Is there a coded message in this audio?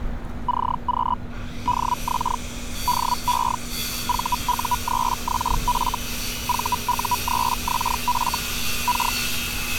Yes: Hellschreiber (Feld-Hell, 122.5 baud) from 0.5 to 9.2 s, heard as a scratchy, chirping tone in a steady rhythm, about 980 Hz, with street noise. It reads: CQ DX DE VU3XF VU3XF K